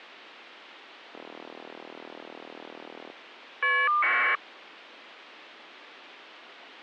Caller ID data burst, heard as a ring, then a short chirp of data, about 1200 baud.